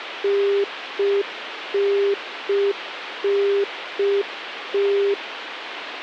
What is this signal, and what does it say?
Telephone call progress tone (UK plan), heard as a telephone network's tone, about 400 Hz, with phone line noise. Congestion tone.